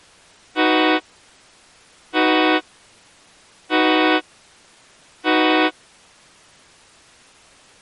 Train horn signal, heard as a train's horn. 4 short. On North American railways: a request for a signal to be given or repeated.